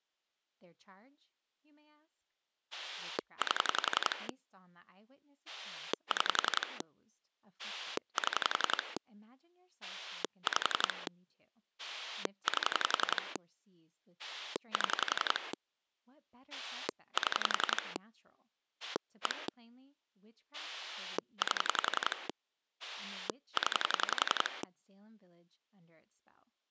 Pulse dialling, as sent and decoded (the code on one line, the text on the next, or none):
8 / 6 / 7 / 5 / 8 / 7 / 7 / 1 / 8 / 10
8 6 7 5 8 7 7 1 8 0